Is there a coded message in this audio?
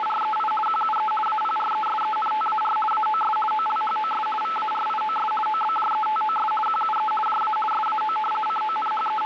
Yes: RTTY (50 baud, 450 Hz shift) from 0.0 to 9.3 s, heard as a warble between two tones, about 1090 Hz centre, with radio static. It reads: … QUE APRESENTAR AOS OLHOS VARIOS OBJETOS QUE JA SAO …